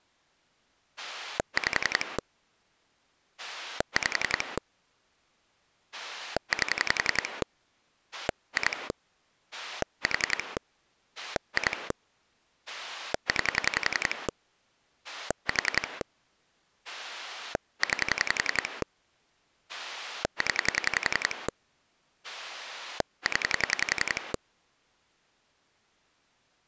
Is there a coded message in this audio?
Yes: pulse dialling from 1.0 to 24.4 s, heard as a rotary dial, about 11 pulses a second. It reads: 5 5 8 2 4 2 9 4 9 0 0